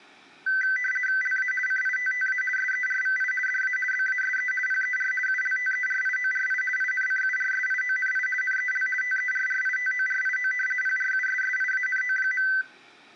RTTY (50 baud, 450 Hz shift), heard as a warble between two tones, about 1750 Hz centre. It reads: LA CITTA SERVI DA BASE PER ULTERIORI INCURSIONI NEL TERRITORIO PRUSSIANO.